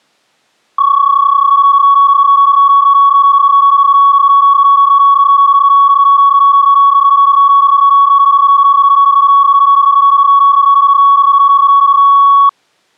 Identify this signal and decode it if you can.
PSK31 (31.25 baud), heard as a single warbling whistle, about 1120 Hz.